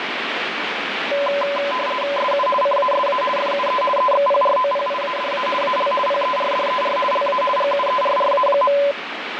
RTTY (50 baud, 450 Hz shift), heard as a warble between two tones, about 790 Hz centre, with radio static. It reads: SU CASA FUE EXPROPIADA AL PERDER LA GUERRA.